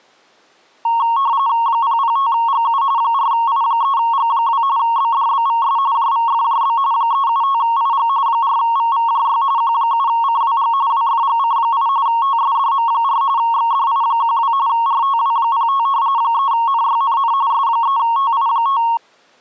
RTTY (45.45 baud, 170 Hz shift), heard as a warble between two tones, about 1010 Hz centre. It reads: 005GU 4I3G2 BDBVS JVFJB 375IG 4VVJY Q7CWG WFGC8 TSDM4 XDI12 RTW05 3NYNN S3TI5